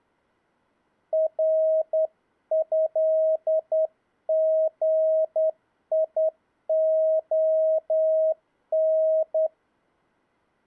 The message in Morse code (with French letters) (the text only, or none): RÉGION